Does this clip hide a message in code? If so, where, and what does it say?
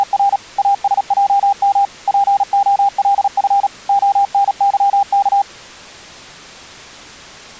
Yes: Morse code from 0.0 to 5.5 s, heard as a keyed tone, machine-sent, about 37 wpm, 800 Hz. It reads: … ASJM POLF ONYK